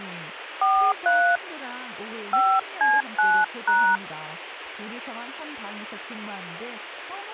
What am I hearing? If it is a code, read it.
DTMF, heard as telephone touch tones, dialled by hand, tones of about 240 ms, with radio hiss and speech in Korean. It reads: 43 5C9#